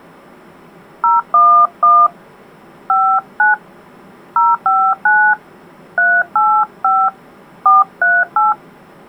DTMF, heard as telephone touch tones, dialled by hand, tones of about 220 ms. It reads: 011 59 059 385 438